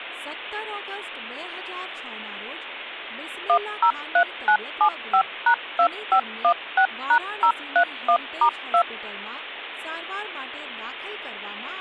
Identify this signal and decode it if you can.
DTMF, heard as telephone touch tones, dialled by machine, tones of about 80 ms, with speech in Gujarati. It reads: 103975#2516#031*2